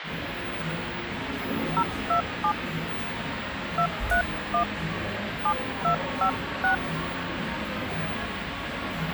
DTMF, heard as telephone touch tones, dialled by hand, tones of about 90 ms, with phone line noise and the noise of a cafe. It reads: 027 231 7256